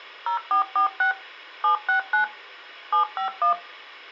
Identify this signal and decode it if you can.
DTMF, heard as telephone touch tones, dialled by machine, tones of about 110 ms. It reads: 0446 769 751